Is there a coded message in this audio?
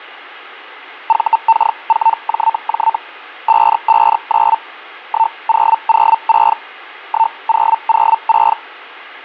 Yes: Hellschreiber (Feld-Hell, 122.5 baud) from 1.1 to 8.6 s, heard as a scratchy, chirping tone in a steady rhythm, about 900 Hz. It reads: VK4JJ 559 1006 1006